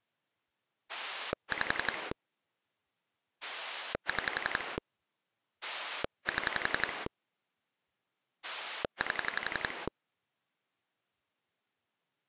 Pulse dialling, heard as a rotary dial, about 11 pulses a second. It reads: 5 6 7 8